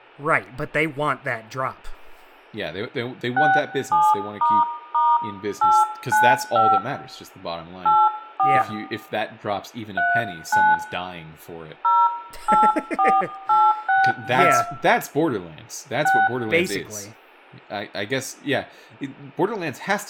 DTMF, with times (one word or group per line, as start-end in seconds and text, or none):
3.4-6.8 67**895
7.9-8.6 84
10.0-10.7 39
11.8-14.6 084862
16.0-16.3 6